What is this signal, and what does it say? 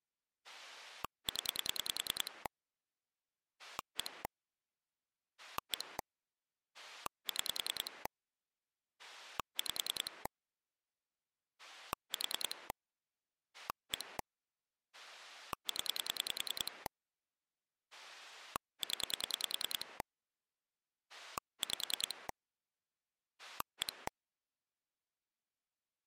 Pulse dialling, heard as a rotary dial, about 10 pulses a second. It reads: 0 1 1 6 5 4 1 0 0 5 1